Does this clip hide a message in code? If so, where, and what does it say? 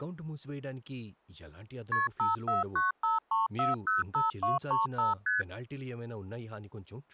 Yes: multi-frequency trunk signalling (R1, as on North American trunks) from 1.9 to 5.4 s, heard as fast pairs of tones, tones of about 160 ms, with speech in Telugu. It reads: KP 54953405235 ST